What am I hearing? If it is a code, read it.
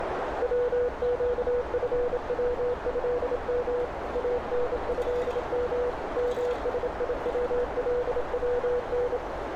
Morse code (Arabic alphabet), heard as a keyed tone, hand-sent with a bug key, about 27 wpm, 490 Hz, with heavy radio static, a narrow filter and street noise. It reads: وقفوهم انهم مسيولون